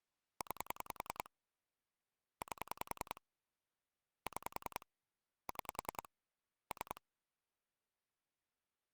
Pulse dialling, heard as clicks on a phone line, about 10 pulses a second. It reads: 9 8 6 6 3